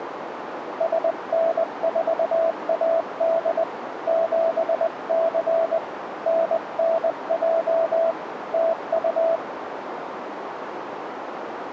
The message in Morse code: SN4AD 7C NNJ TU

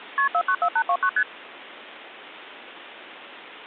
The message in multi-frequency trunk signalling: KP 494829 ST

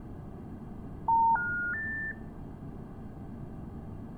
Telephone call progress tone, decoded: special information tone

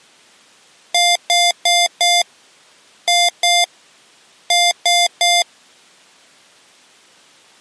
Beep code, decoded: 4-2-3

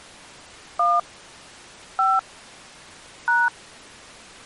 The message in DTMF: 1 5 #

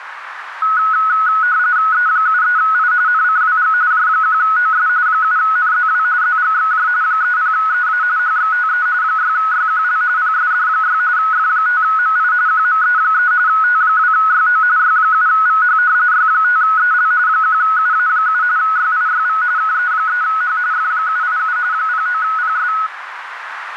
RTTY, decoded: E73I NCWG J1OS 7NZW ZGXJ 30EA HXTE 6YQL PSD6 F5MI QME3 T2YO Y7VH Y5EL 1UA7 YIYV KE3H F787 09PS

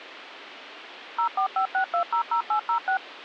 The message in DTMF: 0456200806

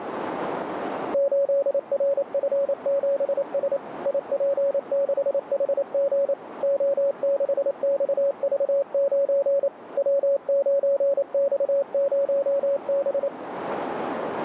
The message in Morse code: 8RF7S IP6HG O6XV9 W9X0B

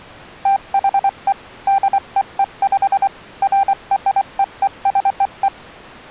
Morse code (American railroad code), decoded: THE DEEP FREEZE

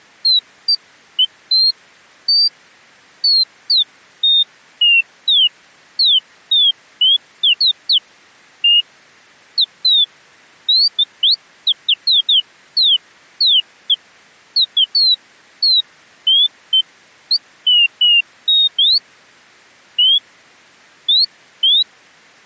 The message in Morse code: none

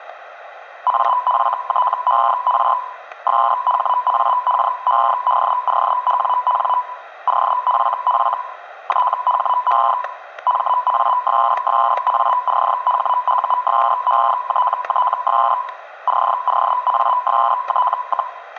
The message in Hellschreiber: AFTER SHAKEDOWN OFF THE MASSACHUSETTS COAST,

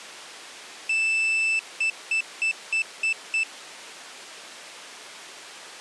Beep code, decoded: 1 long, 6 short

